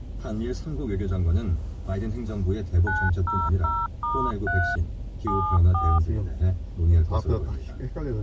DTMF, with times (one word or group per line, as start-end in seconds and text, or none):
2.9-4.8 900*3
5.3-6.0 74